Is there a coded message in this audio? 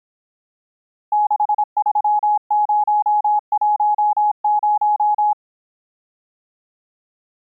Yes: Morse code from 1.1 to 5.4 s, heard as a keyed tone, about 26 wpm, 840 Hz. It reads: 63010